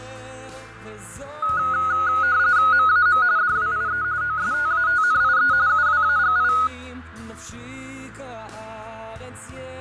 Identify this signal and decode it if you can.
RTTY (45.45 baud, 170 Hz shift), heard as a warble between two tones, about 1360 Hz centre, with radio static and fading. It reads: MAM DWIE OSTATNIE UWAGI